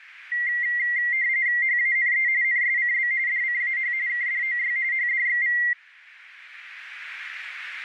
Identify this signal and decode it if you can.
RTTY (45.45 baud, 170 Hz shift), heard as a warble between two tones, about 2000 Hz centre, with radio static. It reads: HANE NSCB DCAH KDOY HDXV